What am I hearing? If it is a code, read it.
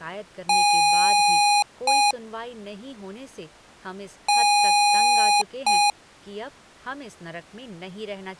Beep code, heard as beeps from a small speaker, played twice, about 820 Hz, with speech in Hindi. 1 long, 1 short. In IBM BIOS tables: system board problem.